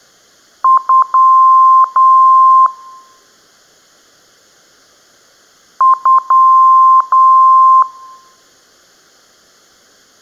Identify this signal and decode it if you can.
Beep code, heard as beeps, played twice, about 1050 Hz, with room echo. 2 short, 2 long.